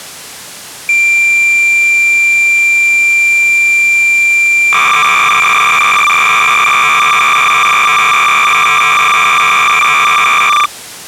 Cassette data (Kansas City type), 300 baud, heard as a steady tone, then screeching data.